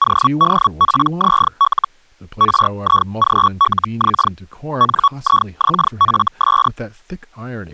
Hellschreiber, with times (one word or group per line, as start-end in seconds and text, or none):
0.0-1.9 ODPZL
2.4-4.3 RIGLX
4.8-6.7 NIXFS